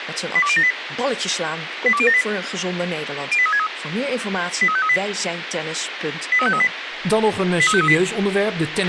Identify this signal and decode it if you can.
Five-tone selective call (ZVEI), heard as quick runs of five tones, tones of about 70 ms, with radio hiss, a squelch burst at the end and speech in Dutch. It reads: 82078 82078 08363 83538 83538 83538